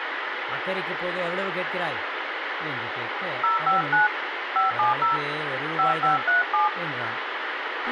DTMF, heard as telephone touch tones, dialled by hand, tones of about 140 ms, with radio hiss, a squelch burst at the end, room echo and speech in Tamil. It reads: 059 570 5537